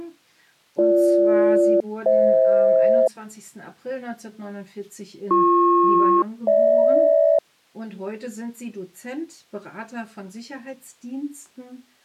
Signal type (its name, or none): aircraft SELCAL